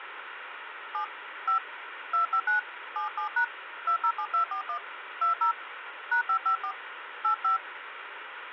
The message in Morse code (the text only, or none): none